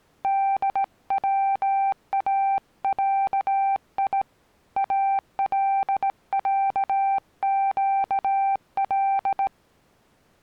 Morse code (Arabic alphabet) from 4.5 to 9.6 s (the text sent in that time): العقل